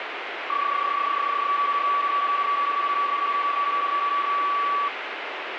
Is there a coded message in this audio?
Yes: PSK31 (31.25 baud) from 0.5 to 4.9 s, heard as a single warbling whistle, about 1140 Hz, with radio static.